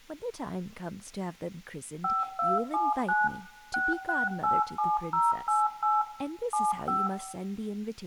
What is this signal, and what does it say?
DTMF, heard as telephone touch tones, dialled by machine, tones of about 190 ms, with room echo and speech in English. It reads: 5279 6687088 75